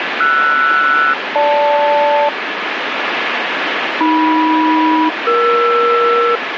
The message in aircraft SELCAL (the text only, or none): RS-GL AM-ER